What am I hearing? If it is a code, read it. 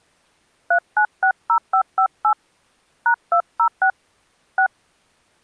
DTMF, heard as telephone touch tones, dialled by hand, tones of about 80 ms. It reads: 3960558 #206 6